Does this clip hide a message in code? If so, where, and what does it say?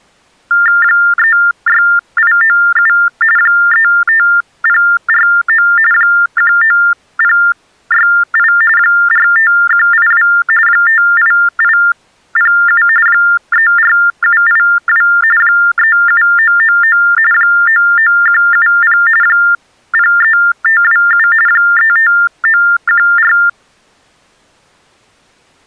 Yes: TTY/TDD text telephone tones (45.45 baud Baudot) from 0.5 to 23.5 s, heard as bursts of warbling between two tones, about 400 Hz shift, 1600 Hz centre. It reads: 36897 35049 19068 45182 58807 34782 37999 99170 03527 35914